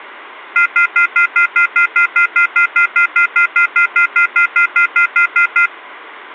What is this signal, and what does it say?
Telephone call progress tone (North American plan), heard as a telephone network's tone, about 1400, 2050, 2450, 2600 Hz, 0.1 s on and 0.1 s off. Off-hook warning tone.